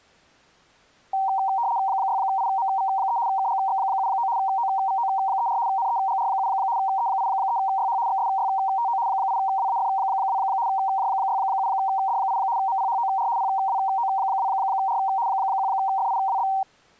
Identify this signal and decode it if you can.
RTTY (75 baud, 170 Hz shift), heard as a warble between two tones, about 860 Hz centre. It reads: 6IMV3 KGX79 OVO34 NEGR7 E83YH XSYTO 8WAF2 J67D8 MPHOR PWO2R 1FIWB